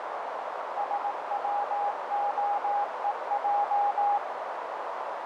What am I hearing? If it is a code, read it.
Morse code (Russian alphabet), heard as a keyed tone, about 18 wpm, 820 Hz, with heavy radio static and a narrow filter. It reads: СВОЕЙ